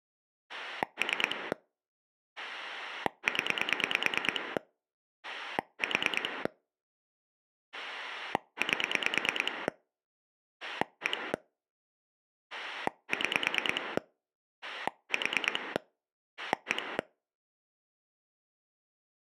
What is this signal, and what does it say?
Pulse dialling, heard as a rotary dial, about 9 pulses a second. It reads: 3 0 4 8 1 6 4 1